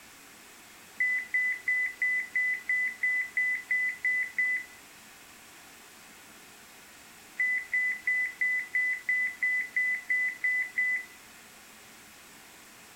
Beep code, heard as beeps, played twice, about 2000 Hz. 11 short. In AMI BIOS tables: cache memory error.